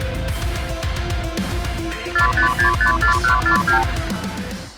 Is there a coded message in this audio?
Yes: multi-frequency trunk signalling (R2, with the far end's replies) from 2.2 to 3.8 s, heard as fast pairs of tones, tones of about 110 ms. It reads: 45654142